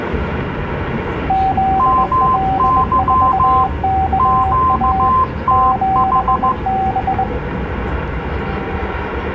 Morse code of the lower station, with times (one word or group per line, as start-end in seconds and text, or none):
1.3-5.1 ZL4KA
5.5-7.2 7B